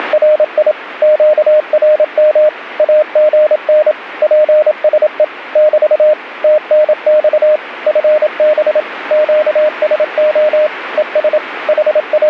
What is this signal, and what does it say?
Morse code, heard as a keyed tone, machine-sent, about 27 wpm, 610 Hz, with radio static. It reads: … QRM AGN PSE <BT> TNX FB QSO ES …